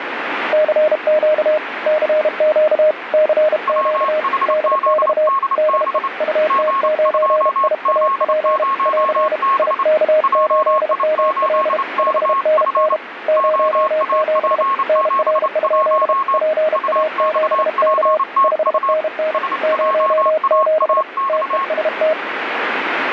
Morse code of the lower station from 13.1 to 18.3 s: 07 NR? PA7K

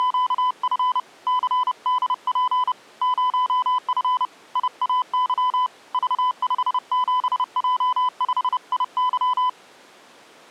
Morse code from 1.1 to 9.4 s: CDP 0F IAY V57J5IY

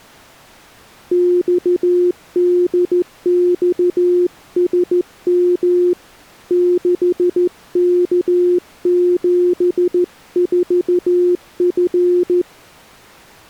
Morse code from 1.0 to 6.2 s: XDXSM

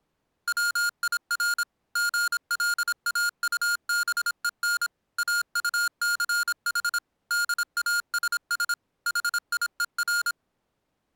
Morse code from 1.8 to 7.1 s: GLAUBEN AUCH

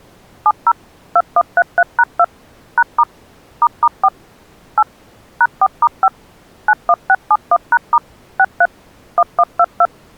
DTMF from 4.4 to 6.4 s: 8 #4*5

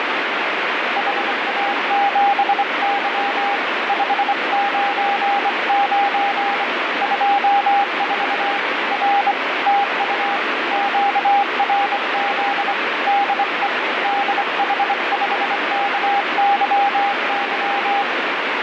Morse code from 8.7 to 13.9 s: R TU QRZ DE

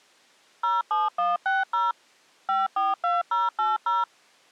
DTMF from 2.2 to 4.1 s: 542080

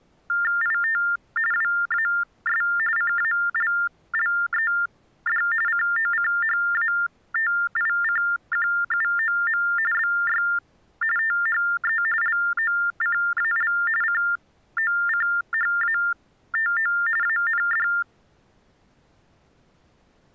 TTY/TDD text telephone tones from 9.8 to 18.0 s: BY THE LOCAL COCHATO AND

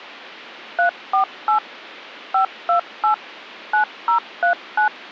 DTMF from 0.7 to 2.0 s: 348

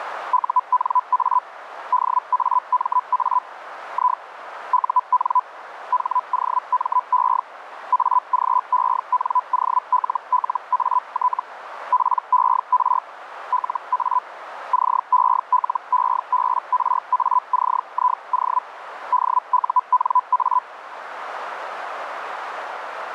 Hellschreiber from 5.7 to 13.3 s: HOME AGENOLLAT PER

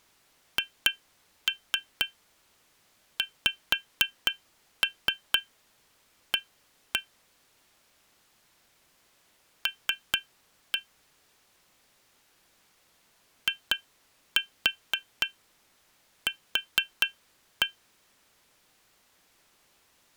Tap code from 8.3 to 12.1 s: L

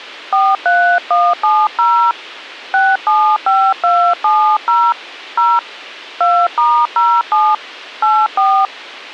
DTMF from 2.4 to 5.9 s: 675270 0

